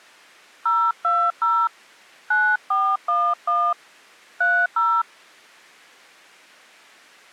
DTMF, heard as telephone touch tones, dialled by hand, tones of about 260 ms. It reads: 020 9411 30